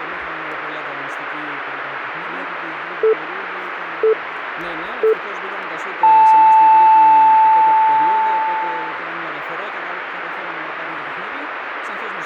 Radio time signal (three low pips and a long one an octave up, as on NHK), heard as pips, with radio static.